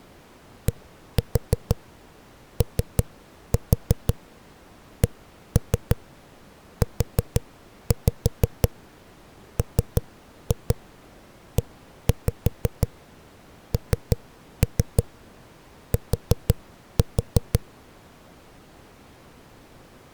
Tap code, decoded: DOCUMENT

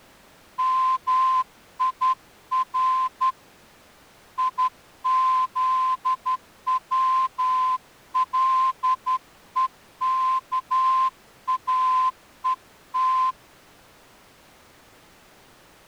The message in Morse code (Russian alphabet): МИР ИЗВЛЕКАЕТ

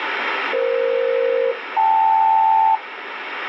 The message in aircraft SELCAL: EF-KL

